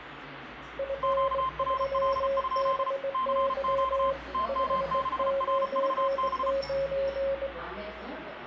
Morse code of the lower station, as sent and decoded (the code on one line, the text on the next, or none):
..-. ...-- -... -.-- / ..... ----. ----.
F3BY 599